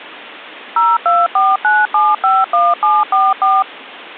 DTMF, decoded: 0249751744

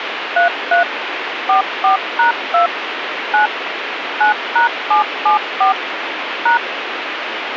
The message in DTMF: 33 44#2 9 9#774 #

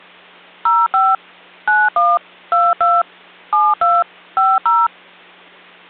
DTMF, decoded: 05 91 22 72 50

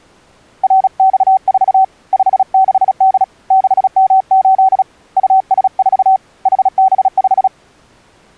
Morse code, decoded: RX4 56D 6M8 US4 HB5

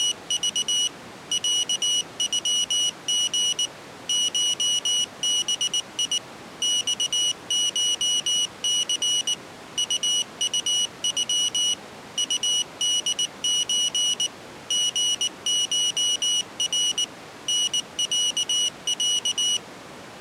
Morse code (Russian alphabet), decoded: … ЯЮГ ШБИ ЬШЦ УУЮ УДЧ ГШР НЯЯ

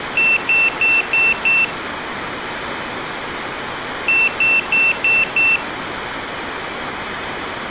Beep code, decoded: 5 short

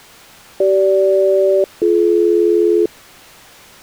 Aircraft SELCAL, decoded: CG-BD

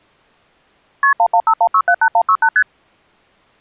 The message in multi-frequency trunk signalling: KP 1151678168 ST

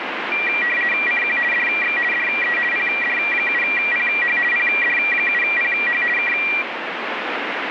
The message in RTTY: CQ DX DE PD7PH PD7PH K

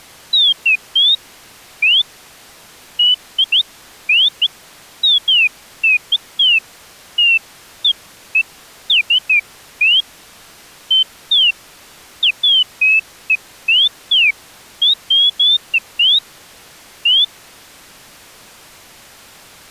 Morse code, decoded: none

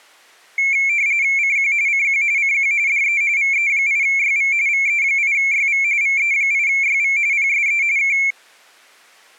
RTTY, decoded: CQ CQ CQ DE VE8YV VE8YV VE8YV PSE K

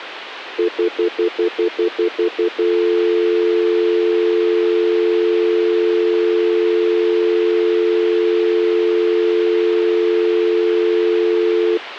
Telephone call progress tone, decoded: stutter dial tone

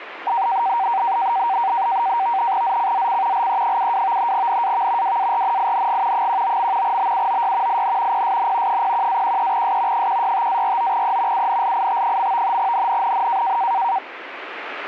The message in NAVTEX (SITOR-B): ZCZC LE72 NAV WARNING 19. BUOY IN PSN 01-13S 165-49E UNLIT. NNNN

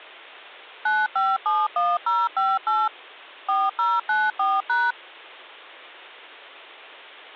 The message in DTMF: 9571058 4094#

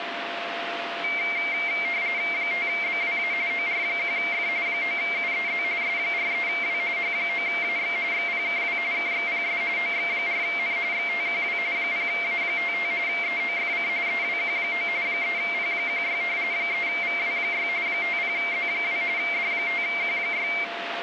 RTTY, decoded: 5BWA OR1F 9UEZ S43W H9AX XPKW KXPS OX4N XTQW 0A55 EOFC EWQ9 3P16 3VW6 50Z2 D5Q6

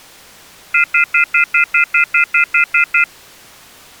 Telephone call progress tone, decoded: off-hook warning tone

